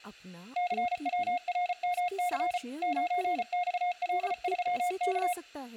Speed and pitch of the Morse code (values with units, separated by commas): 34 wpm, 720 Hz